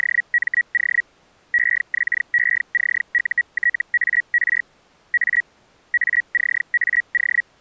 Hellschreiber (Feld-Hell, 122.5 baud), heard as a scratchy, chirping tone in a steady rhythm, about 1900 Hz. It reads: … EXECUTAR A ACAO